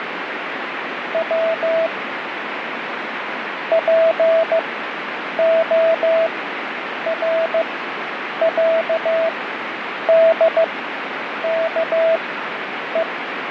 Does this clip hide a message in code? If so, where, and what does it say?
Yes: Morse code (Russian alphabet) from 1.1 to 13.1 s, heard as a keyed tone, machine-sent, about 15 wpm, spaced as for 8 wpm, 660 Hz, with radio static and fading. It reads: В ПОРЯДКЕ